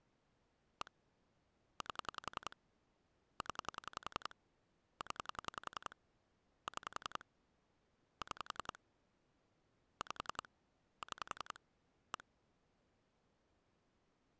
Pulse dialling, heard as clicks on a phone line, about 10 pulses a second. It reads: 1 8 0 0 6 6 5 6 1